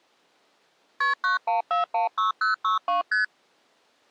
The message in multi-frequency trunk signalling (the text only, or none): KP 91416062 ST